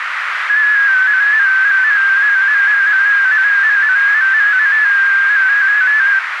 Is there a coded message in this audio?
Yes: multi-tone FSK (Olivia or MFSK type), about 250 Hz wide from 0.5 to 6.2 s, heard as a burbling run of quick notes, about 15.625 baud, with radio static and a narrow filter.